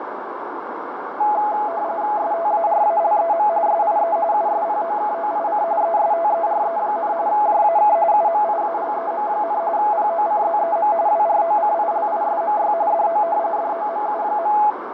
RTTY (45.45 baud, 170 Hz shift), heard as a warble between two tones, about 760 Hz centre, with radio static, fading and a narrow filter. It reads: STARALEM SIE USPOKOIC ESTERE, JAK UMIALEM, POCZEM WROCILISMY DO DOMU.